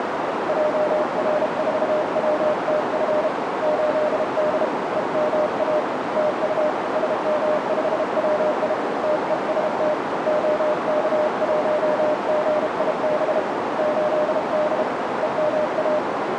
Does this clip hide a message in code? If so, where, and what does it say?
Yes: Morse code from 0.4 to 16.0 s, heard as a keyed tone, hand-sent with a bug key, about 32 wpm, 610 Hz, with heavy radio static and a narrow filter. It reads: JR4WTF 8D EMA TU SM5WI TEST OK1GIB 8D EMA